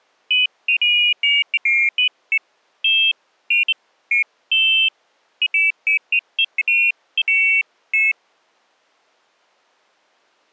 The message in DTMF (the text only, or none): none